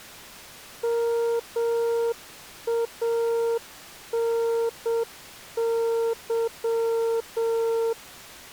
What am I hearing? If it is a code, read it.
Morse code, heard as a keyed tone, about 7 wpm, 460 Hz. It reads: MANY